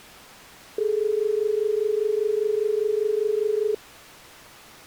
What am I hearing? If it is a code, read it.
Telephone call progress tone (as in Australia), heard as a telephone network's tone, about 430 Hz. Dial tone.